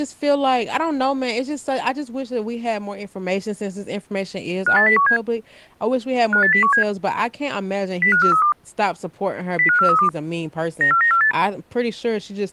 Five-tone selective call (CCIR), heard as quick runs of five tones, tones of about 100 ms, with speech in English. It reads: 58017 58017 05432 05432 94948